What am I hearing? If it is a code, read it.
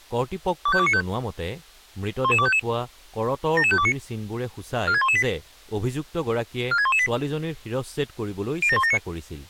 Five-tone selective call (ZVEI), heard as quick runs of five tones, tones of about 70 ms, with speech in Assamese. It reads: 25295 11255 77529 46118 46118 07179